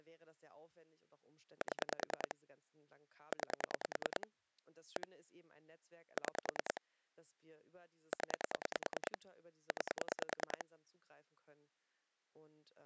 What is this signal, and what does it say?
Pulse dialling, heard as clicks on a phone line, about 10 pulses a second, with speech in German. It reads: 7 9 1 6 0 9